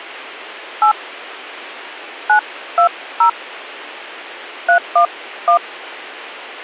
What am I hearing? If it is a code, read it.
DTMF, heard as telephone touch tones, dialled by hand, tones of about 100 ms. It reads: 8 920 311